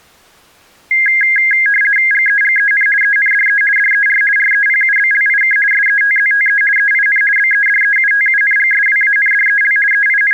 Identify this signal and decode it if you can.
RTTY (50 baud, 450 Hz shift), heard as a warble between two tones, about 1850 Hz centre. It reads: GEGEN ENDE DER REPUBLIK SETZTE EIN BEDEUTUNGSWANDEL …